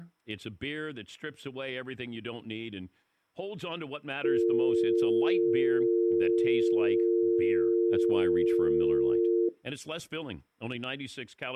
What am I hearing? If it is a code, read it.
Telephone call progress tone (North American or UK plan), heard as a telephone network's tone, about 350, 450 Hz, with speech in English. Dial tone.